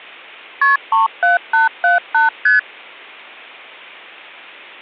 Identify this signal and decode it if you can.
Multi-frequency trunk signalling (R1, as on North American trunks), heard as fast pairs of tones, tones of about 140 ms. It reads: KP 37878 ST